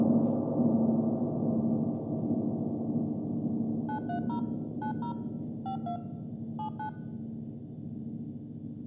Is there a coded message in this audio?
Yes: DTMF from 3.9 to 6.9 s, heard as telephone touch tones, dialled by machine, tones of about 100 ms. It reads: 930 90 52 79